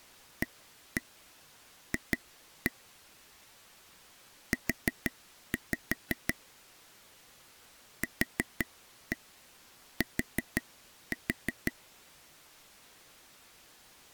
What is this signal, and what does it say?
Tap code, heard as taps on a table, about 5 knocks a second. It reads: AF U QT